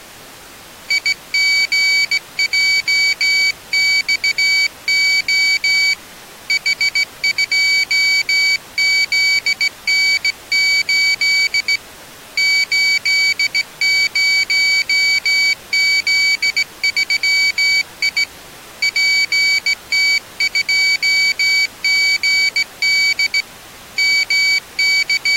Morse code, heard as a high beeper, hand-sent with a straight key, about 17 wpm, 2300 Hz. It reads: IGJXO H2ZN8 80Z3I PT2GD …